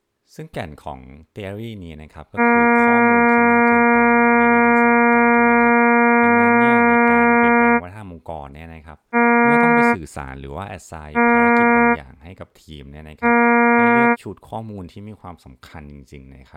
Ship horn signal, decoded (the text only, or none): 1 long, 3 short